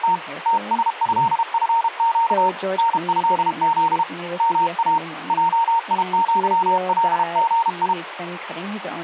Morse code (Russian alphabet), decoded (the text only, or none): … ТСЭФЩ НЭЗ МА ЙИЪЛГИ